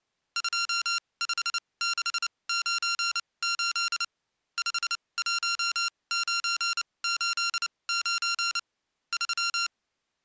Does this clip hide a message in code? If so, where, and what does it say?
Yes: Morse code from 0.3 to 9.7 s, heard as electronic beeps, machine-sent, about 29 wpm, spaced as for 22 wpm, 1380 Hz. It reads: 25698 51989 3